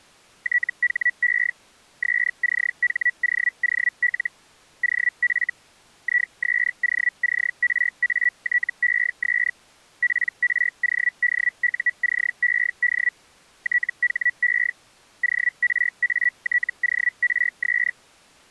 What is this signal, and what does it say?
Hellschreiber (Feld-Hell, 122.5 baud), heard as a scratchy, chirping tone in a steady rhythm, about 1950 Hz. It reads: THE SCHOOL OF ISOCRATES PRODUCED THE ORATORS